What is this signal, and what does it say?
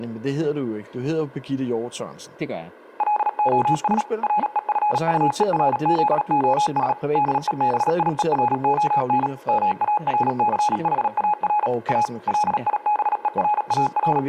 Morse code, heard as a keyed tone, machine-sent, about 37 wpm, 840 Hz, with room echo and speech in Danish. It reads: LOS REFUERZOS DEBIERON MARCHAR A …